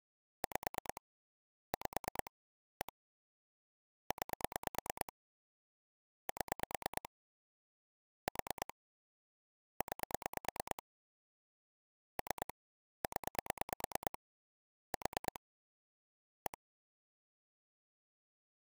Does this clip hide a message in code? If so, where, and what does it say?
Yes: pulse dialling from 0.4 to 16.5 s, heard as clicks on a phone line, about 9 pulses a second. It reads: 5 5 1 9 7 4 9 3 0 4 1